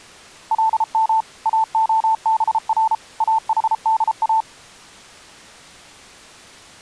Morse code (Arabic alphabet), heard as a keyed tone, machine-sent, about 33 wpm, 890 Hz. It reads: لم اخبر احدا